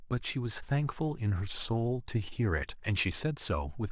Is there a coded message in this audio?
No, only speech in English.